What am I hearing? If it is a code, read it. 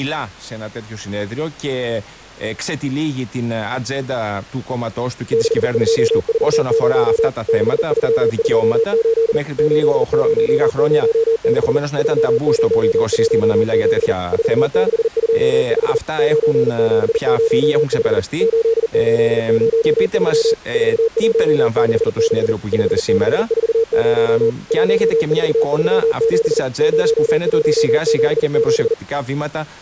Morse code, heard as a keyed tone, machine-sent, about 40 wpm, 450 Hz. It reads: 6240 6328 8006 3017 4625 9705 8803 4166 5640 1437 0177